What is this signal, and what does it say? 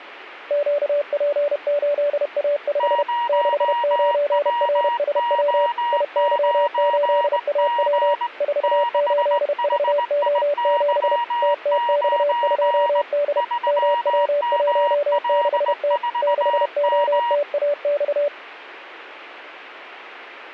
Morse code, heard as two keyed tones. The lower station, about 31 wpm, 580 Hz: QP8A5 69RSW IY8AW 48VO7 TTX2D MW16T 6OTAX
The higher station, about 19 wpm, 950 Hz: 0WO9G 6HIY9 3ML4M